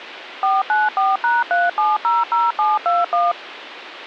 DTMF, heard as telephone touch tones, dialled by machine, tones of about 190 ms, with phone line noise. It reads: 494#3700721